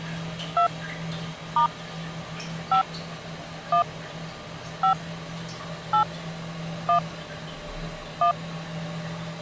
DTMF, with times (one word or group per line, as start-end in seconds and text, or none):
0.6-0.7 2
1.6-1.7 *
2.7-2.8 5
3.7-3.8 1
4.8-4.9 5
5.9-6.0 8
6.9-7.0 1
8.2-8.3 1